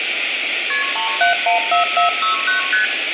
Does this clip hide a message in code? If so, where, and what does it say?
Yes: multi-frequency trunk signalling (R1, as on North American trunks) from 0.7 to 2.8 s, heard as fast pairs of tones, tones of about 130 ms, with phone line noise and room echo. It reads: KP 3714469 ST